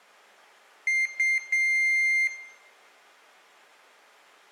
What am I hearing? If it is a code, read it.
Beep code, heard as a piezo beeper, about 2100 Hz, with room echo. 2 short, 1 long.